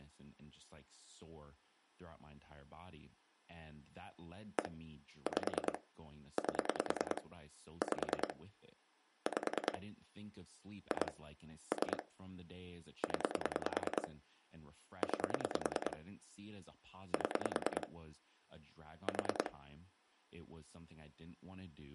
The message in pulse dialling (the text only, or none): 1 5 8 5 5 2 3 0 9 7 4